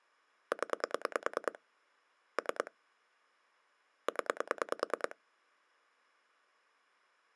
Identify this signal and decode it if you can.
Pulse dialling, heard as clicks on a phone line, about 9 pulses a second. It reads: 0 3 0